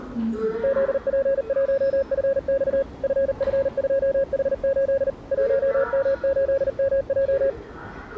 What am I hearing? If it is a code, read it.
Morse code, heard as a keyed tone, machine-sent, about 39 wpm, 550 Hz, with the noise of a subway station. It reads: ZP1FX FF2H8 1M8MJ